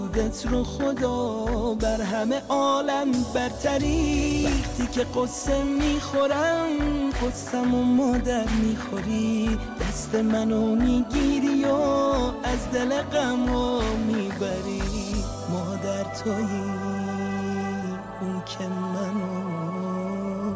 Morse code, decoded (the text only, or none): none